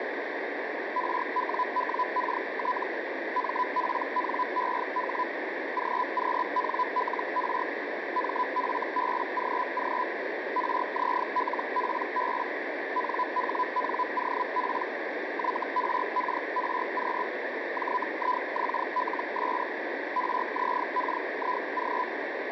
Hellschreiber (Feld-Hell, 122.5 baud), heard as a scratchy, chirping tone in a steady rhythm, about 1000 Hz, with radio static. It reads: RWWKT MPNEH GQNLR MFBGG RZLPB NHNOP YRKRQ JIXLS RZKIG